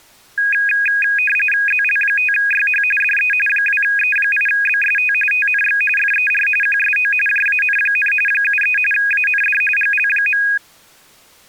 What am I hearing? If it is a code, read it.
RTTY (45.45 baud, 850 Hz shift), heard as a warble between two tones, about 2050 Hz centre. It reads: ZL5YH DE 2E8BST TNX FER QSO JAN, 73 AND GL.